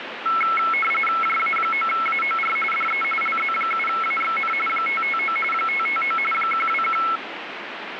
RTTY (45.45 baud, 850 Hz shift), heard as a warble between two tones, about 1750 Hz centre, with radio static. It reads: JA9AOR DE LZ7AXN 559 559 121